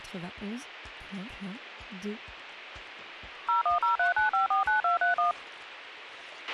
DTMF, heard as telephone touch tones, dialled by machine, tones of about 130 ms, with a squelch burst at the end. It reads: 01039549231